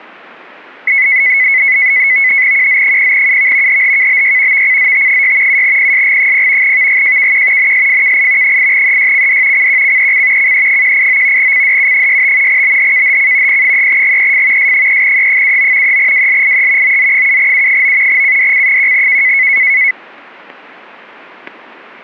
NAVTEX (SITOR-B), 100 baud, 170 Hz shift, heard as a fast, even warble, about 2100 Hz centre, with static crashes. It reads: QZ0UV HHKBY VCZT6 7PSG0 VGJKQ NSFKI 8EYCD CQCEC CE189 CDU65 BHKHC P3GEF S3E79 3WLIE OZ7U9 CDC1K